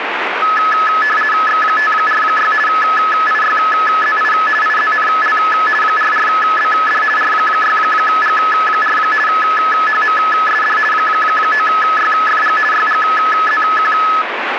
RTTY (50 baud, 450 Hz shift), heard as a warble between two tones, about 1500 Hz centre, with radio static. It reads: X546 IYZI IZNL 44BD R6G4 HMSD 9YFG YGZQ